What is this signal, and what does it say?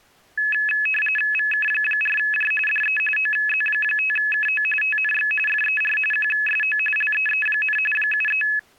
RTTY (45.45 baud, 850 Hz shift), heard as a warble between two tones, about 2150 Hz centre. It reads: VK4J DE OZ5KO TNX FER QSO LEE, 73